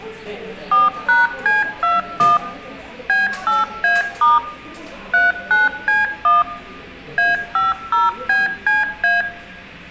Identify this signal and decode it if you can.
DTMF, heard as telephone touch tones, dialled by machine, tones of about 170 ms, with room echo and the noise of a cafe. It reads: 4#C21 B8A* 39C1 A50BCA